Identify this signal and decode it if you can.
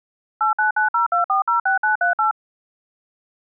DTMF, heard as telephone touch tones, dialled by machine, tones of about 120 ms. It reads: 89902406938